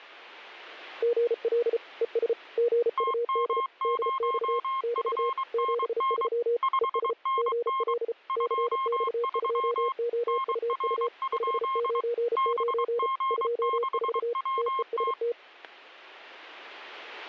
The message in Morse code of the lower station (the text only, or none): GL ES GUD DX <BT> 73 ES GL CX2OUU 599 24 TEST